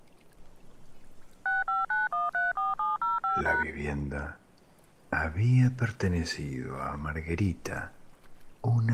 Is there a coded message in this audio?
Yes: DTMF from 1.5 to 3.6 s, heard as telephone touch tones, dialled by machine, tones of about 170 ms. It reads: 659134705#